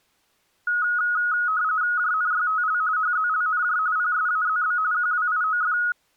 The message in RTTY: JNYTL HZLNJ PSAZB QWIOF

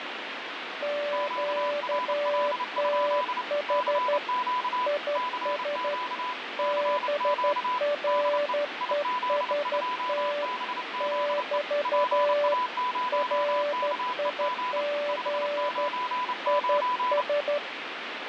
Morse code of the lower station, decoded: QTH IS BREST <BT> RIG IS

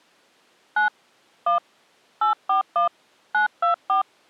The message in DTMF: 9 1 841 924

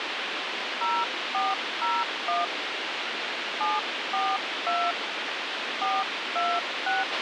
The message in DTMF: 0401 742 426

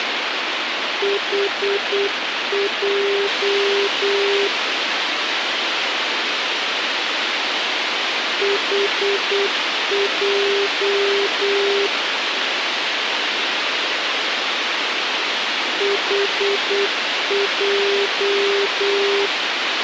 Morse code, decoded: HJ HJ HJ

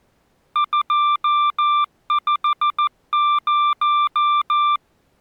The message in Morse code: 250

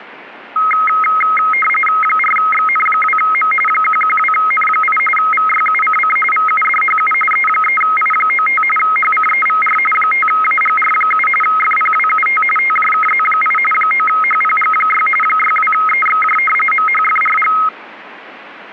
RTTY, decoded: 4XN2M 112N8 VYUCC VUDHU E3I95 HCEVR 5AGR7 FPWUT TJKZ8 9HPG6 62EXJ MHFRG

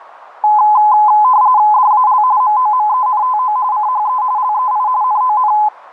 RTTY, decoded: DAL MOMENTO CHE LEI NON

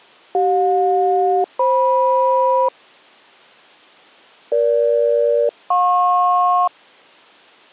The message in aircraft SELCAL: CJ-FM EG-JP

